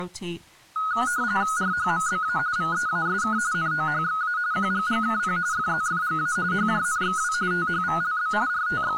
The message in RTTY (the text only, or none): RHMBA VEASK NOHXA QGGKP FZFGA HJNXW THVLB …